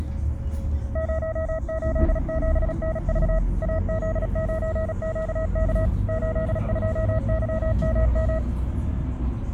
Morse code, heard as a keyed tone, machine-sent, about 36 wpm, 640 Hz, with the noise inside a bus. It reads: 087NV AZ9QK 82YMM